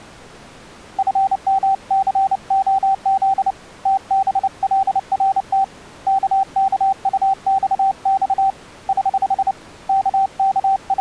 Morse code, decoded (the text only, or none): FMCOZ TBLRT KKUXX <HH> …